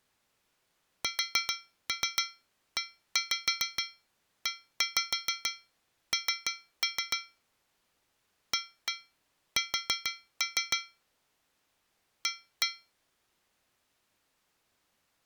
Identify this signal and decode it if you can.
Tap code, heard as taps on a metal pipe, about 6 knocks a second. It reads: SEEN AS A